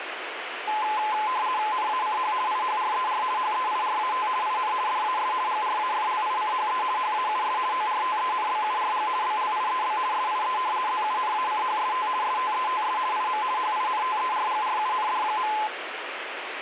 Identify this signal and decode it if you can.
RTTY (50 baud, 170 Hz shift), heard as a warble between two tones, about 940 Hz centre, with radio static. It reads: NACH IHRER HEIRAT IN DAS GRAFLICHE HAUS ORTENBURG BLIEB SIE ZUNACHST STETS IM HINTERGRUND.